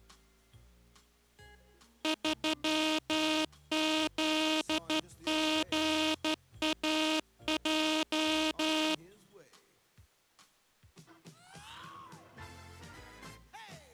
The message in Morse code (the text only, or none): 3ZGAJ